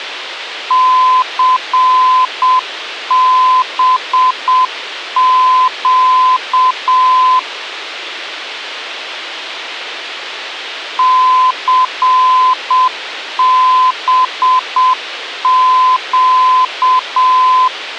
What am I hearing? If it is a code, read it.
Morse code, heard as a keyed tone, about 7 wpm, 1020 Hz, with radio hiss. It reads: CBQ CBQ